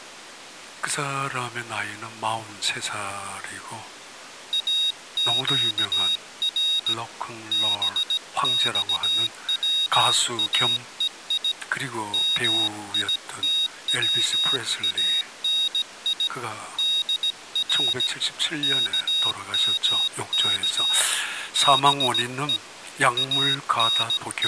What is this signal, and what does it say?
Morse code (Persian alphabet), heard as a high beeper, hand-sent with a paddle, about 17 wpm, 3750 Hz. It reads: اگر بخواهی میتوانی در کمک به …